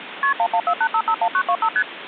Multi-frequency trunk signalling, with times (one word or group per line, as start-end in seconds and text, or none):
0.2-0.3 KP
0.4-1.7 1148551925
1.8-1.8 ST